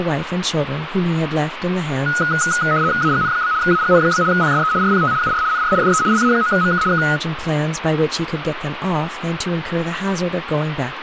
RTTY (75 baud, 170 Hz shift), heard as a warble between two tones, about 1360 Hz centre, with radio static and speech in English. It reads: AGN? AGN? PSE RPT UR NR DE LA9MK K